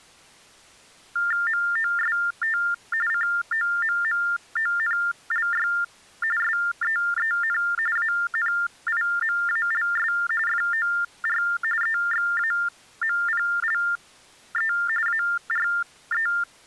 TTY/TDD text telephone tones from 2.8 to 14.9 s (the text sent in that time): COMMONLY SEEN ANIMALS FOR EXAMPLE